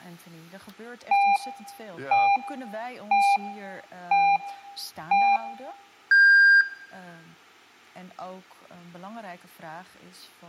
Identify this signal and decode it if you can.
Radio time signal (five pips and a higher one, as on Chinese radio), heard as pips, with room echo and speech in Dutch.